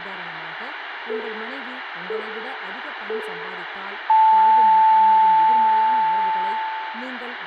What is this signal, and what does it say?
Radio time signal (three low pips and a long one an octave up, as on NHK), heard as pips, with radio static, room echo and speech in Tamil.